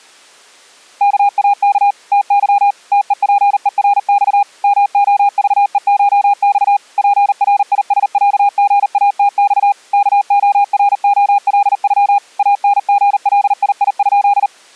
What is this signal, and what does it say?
Morse code (Russian alphabet), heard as a keyed tone, machine-sent, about 39 wpm, 810 Hz. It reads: КАК ТЫ ТЕПЕРЬ МОЖЕШЬ ПРИСЯГАТЬ КОРОЛЮ АНГЛИИ?